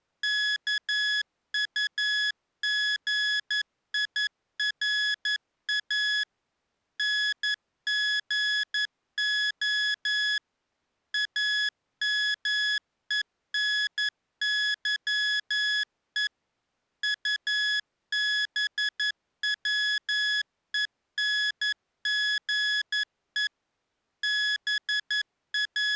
Morse code, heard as electronic beeps, machine-sent, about 11 wpm, 1700 Hz. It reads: KUGIRA NGO AMENYE UBWENGE …